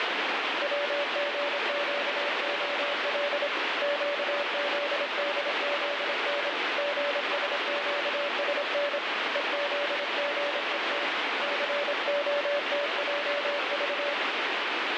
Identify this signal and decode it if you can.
Morse code, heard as a keyed tone, hand-sent with a paddle, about 26 wpm, 580 Hz, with heavy radio static. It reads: WGQOL QZDZN GSQSN EZGET COTJV